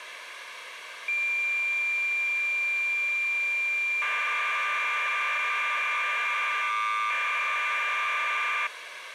Cassette data (Kansas City type), 1200 baud, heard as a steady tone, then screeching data, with tape hiss.